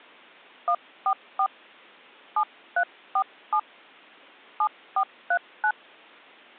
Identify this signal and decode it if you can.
DTMF, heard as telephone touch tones, dialled by hand, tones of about 70 ms. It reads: 144 7347 7439